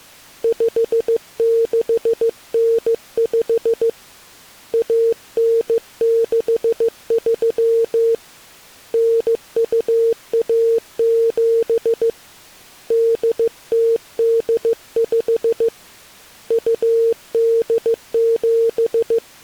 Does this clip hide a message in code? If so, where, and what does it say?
Yes: Morse code (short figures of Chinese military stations) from 0.4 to 19.4 s, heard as a keyed tone, hand-sent with a bug key, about 15 wpm, 460 Hz. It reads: 5695 1963 9217 8085 …